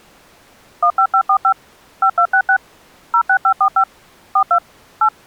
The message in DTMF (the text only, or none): 15545 5266 06545 42 8